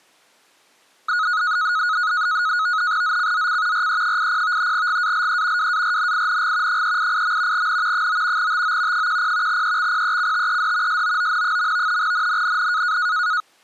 NAVTEX (SITOR-B), 100 baud, 170 Hz shift, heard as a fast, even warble, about 1360 Hz centre. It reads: ZCZC RE80 GALE WARNING 388. N 9 TO 10 EXPECTED SOON. NNNN